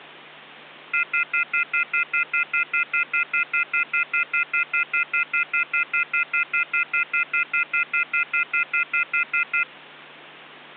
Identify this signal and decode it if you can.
Telephone call progress tone (North American plan), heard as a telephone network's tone, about 1400, 2050, 2450, 2600 Hz, 0.1 s on and 0.1 s off, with hum. Off-hook warning tone.